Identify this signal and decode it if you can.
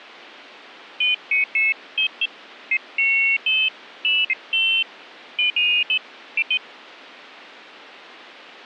Pairs of high tones at irregular times. There is no code.